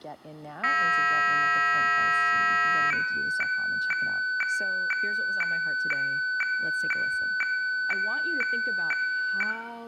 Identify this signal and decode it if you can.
Weather fax (radiofax), 120 lines a minute, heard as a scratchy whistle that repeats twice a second, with room echo and speech in English.